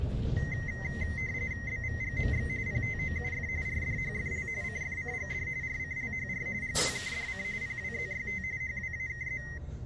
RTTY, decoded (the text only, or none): BVGMX PTOUF RDHFL CFCGD RCLHR GWKDC PWZYT HWAKZ